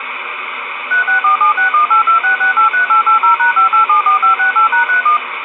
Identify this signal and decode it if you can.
DTMF, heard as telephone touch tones, dialled by machine, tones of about 120 ms, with phone line noise. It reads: 364761826683880#5874568#31